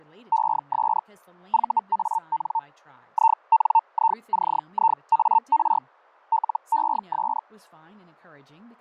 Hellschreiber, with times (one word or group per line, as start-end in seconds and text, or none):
0.3-1.0 ES
1.5-2.6 VAN
3.1-5.8 INICIAR
6.3-7.4 LES